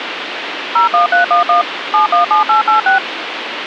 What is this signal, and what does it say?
DTMF, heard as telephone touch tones, dialled by machine, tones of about 130 ms, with phone line noise. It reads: 01311 717886